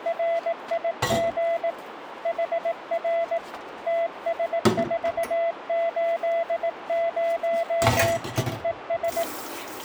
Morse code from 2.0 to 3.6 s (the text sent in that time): HR